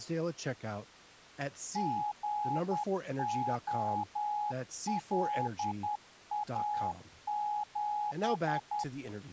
Morse code, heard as a keyed tone, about 10 wpm, 840 Hz, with speech in English. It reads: GOLA7